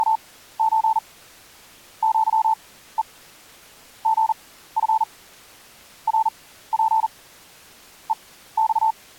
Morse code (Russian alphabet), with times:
0.0-1.0 …
2.0-3.0 ЪЕ
4.1-5.0 ГФ
6.1-7.1 РП
8.1-8.9 ЕЬ

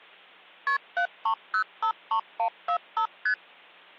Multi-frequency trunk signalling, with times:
0.7-0.8 KP
1.0-3.1 73053145
3.3-3.3 ST

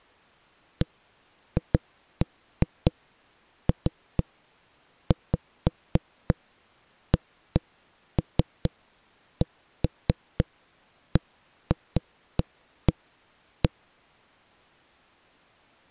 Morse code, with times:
none

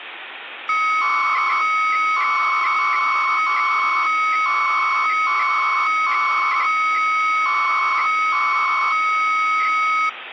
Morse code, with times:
none

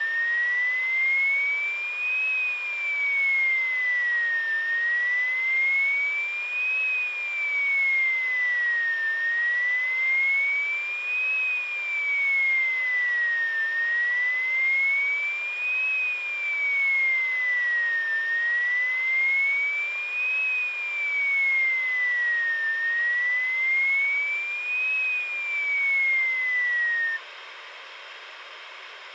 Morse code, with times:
none

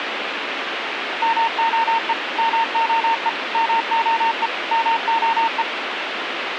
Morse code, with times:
1.2-2.1 MOE
2.4-3.3 MOE
3.5-4.5 MOE
4.7-5.6 MOE

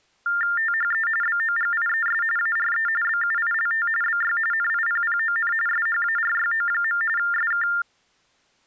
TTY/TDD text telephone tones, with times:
0.6-1.1 THE
1.2-2.2 BOGIES
2.4-2.9 ARE
3.0-3.9 BUILT
4.0-4.4 BY
4.5-5.5 NIPPON
5.7-7.0 SHARYO.
7.2-7.7 SK

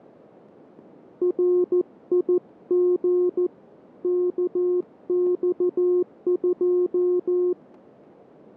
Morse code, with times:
1.2-3.5 RIG
4.0-7.5 KX2

